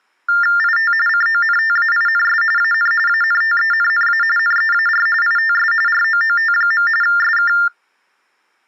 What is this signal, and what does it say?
TTY/TDD text telephone tones (45.45 baud Baudot), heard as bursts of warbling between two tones, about 400 Hz shift, 1600 Hz centre. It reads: IT CONTAINS AN ANTENNA NEAR ITS ROOT. SK